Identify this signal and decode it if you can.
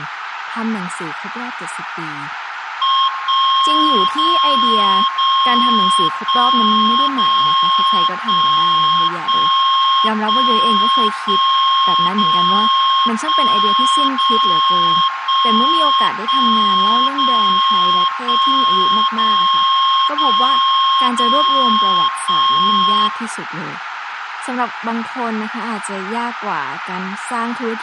Radio time signal (DCF77), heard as a tone whose level steps once a second, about 1070 Hz, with radio static, a narrow filter, room echo and speech in Thai. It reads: 1 0 0 1 0 1 1 1 1 0 1 0 1 1 0 1 0 0 0 1